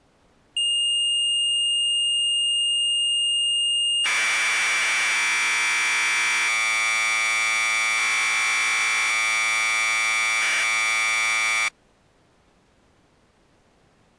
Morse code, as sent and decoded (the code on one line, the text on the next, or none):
none